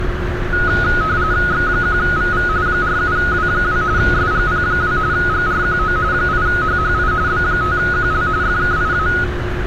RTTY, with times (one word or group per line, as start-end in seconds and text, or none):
1.5-2.5 X1VV
2.7-3.8 47W2
4.0-5.0 SGP2
5.1-6.0 GRQO
6.1-7.1 8HHI
7.3-8.3 B5QL
8.4-9.1 FKIA